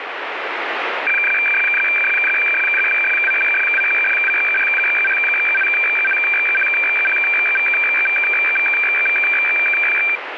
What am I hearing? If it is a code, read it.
Weather fax (radiofax), 120 lines a minute, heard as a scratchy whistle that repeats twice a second, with radio static.